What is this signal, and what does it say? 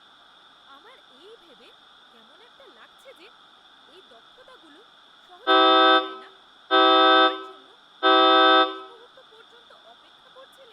Train horn signal, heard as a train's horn, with room echo and speech in Bangla. 3 short. On North American railways: when stopped, the train will back up.